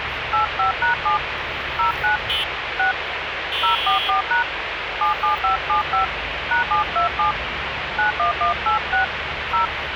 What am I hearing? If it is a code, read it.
DTMF, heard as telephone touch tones, dialled by hand, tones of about 120 ms, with radio hiss and street noise. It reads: 85#7 09 6 044# 77575 #727 91186 0